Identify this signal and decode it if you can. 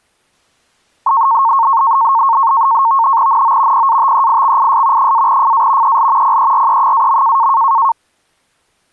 NAVTEX (SITOR-B), 100 baud, 170 Hz shift, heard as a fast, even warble, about 1000 Hz centre. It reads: NO PATEIXIS -FA EL PERE-.